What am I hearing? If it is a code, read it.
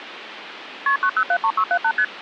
Multi-frequency trunk signalling (R1, as on North American trunks), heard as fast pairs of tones, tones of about 70 ms, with phone line noise. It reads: KP 9073678 ST